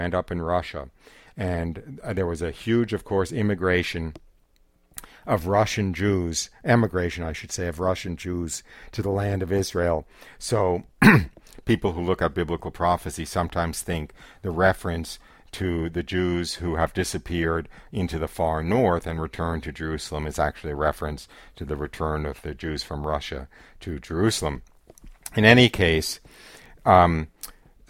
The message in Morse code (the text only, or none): none